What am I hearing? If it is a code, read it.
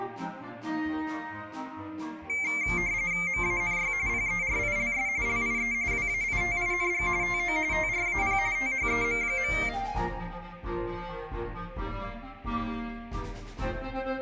RTTY (45.45 baud, 170 Hz shift), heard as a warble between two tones, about 2200 Hz centre. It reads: MANY PERILS LIE WAITING TO TRAP THEM.